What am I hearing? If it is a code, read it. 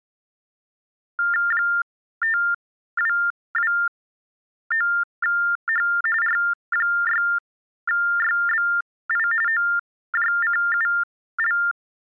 TTY/TDD text telephone tones (45.45 baud Baudot), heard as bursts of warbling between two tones, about 400 Hz shift, 1600 Hz centre. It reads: 5229H R6YBI OJCUL